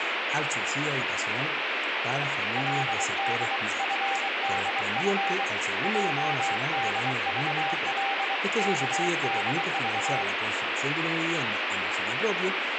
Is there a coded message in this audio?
Yes: Morse code (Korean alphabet) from 2.5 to 10.3 s, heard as a keyed tone, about 23 wpm, 790 Hz, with radio static. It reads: 그는 흙을